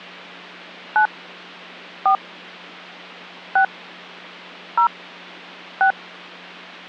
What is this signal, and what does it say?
DTMF, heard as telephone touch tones, dialled by hand, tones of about 100 ms, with hum. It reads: 9 4 6 0 6